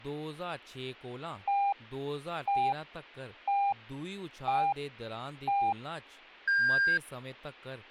Radio time signal (five pips and a higher one, as on Chinese radio), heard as pips, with speech in Dogri.